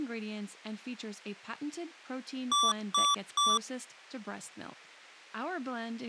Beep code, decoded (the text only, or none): 3 short